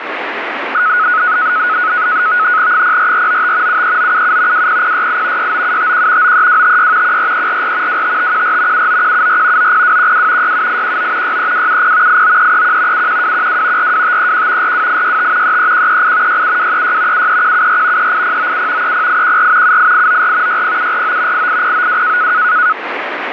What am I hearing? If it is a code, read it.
NAVTEX (SITOR-B), 100 baud, 170 Hz shift, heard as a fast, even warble, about 1370 Hz centre, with radio static. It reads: 04495 73977 20068 69751 93256 14344 25514 79174 90212 67819 63270 89331 71212 42531 42865 33138 67236 73174 38097 30814 78894 60749 88092